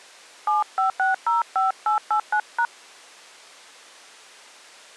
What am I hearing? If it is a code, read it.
DTMF, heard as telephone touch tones, dialled by hand, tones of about 110 ms. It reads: 75605889#